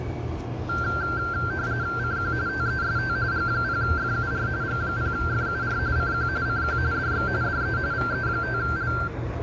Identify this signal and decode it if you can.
RTTY (45.45 baud, 170 Hz shift), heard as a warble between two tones, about 1470 Hz centre, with static crashes, room echo and street noise. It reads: CQ TEST G0FUR G0FUR CQ CQ DX DE VE5L